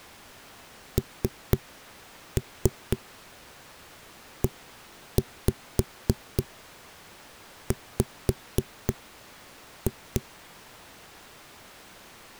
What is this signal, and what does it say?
Tap code, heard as knocks on a wall, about 4 knocks a second. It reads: NEW